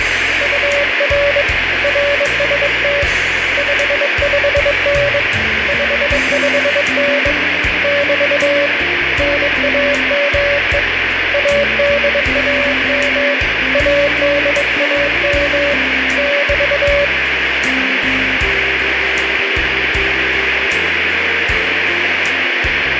Morse code, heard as a keyed tone, hand-sent with a bug key, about 22 wpm, 570 Hz, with radio static. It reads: UR RST 55N 55N <BT> NAME ADAM ADAM <BT>